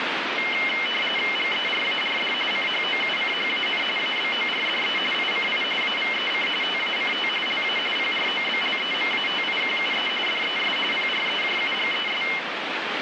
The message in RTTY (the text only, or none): GERARD CHOUCHAN ABORDE ICI AVEC TACT LA PROBLEMATIQUE DES PREJUGES